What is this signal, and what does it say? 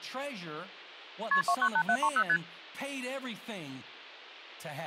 Multi-frequency trunk signalling (R1, as on North American trunks), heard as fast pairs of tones, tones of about 70 ms, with speech in English. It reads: KP 298730 ST